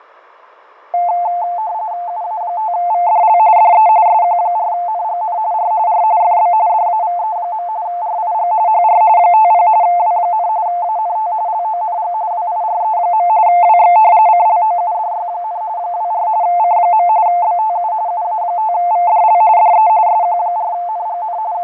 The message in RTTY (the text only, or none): UA5VDL DE SQ4NGN R R FB DAVE. RIG HR 50 W, ANT LONG WIRE. WX CLOUDY, 24 C. BTU UA5VDL DE SQ4NGN …